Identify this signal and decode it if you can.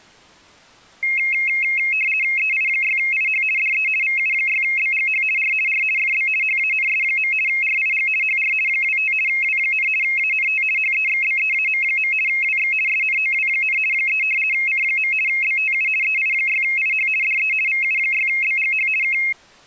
RTTY (50 baud, 450 Hz shift), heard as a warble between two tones, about 2350 Hz centre. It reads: EI6IH DE VU6BGH R R FB HANS. RIG HR 25 W, ANT HEXBEAM. WX SNOW, 3 C. BTU EI6IH DE VU6BGH K